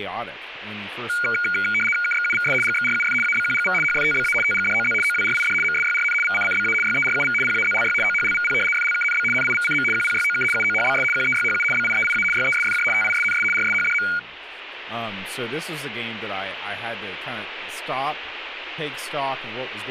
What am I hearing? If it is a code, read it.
RTTY (75 baud, 850 Hz shift), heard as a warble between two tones, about 1850 Hz centre, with speech in English. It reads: KXUVS GXRUF ABQGV HFTBA TGDOZ OWRID MSYRN VCCBA YERUV PAZLY OHLVP FLKNB NIVCM QPYOK UOHBS QEYHU BIEIA YESFJ TISNS RSHDM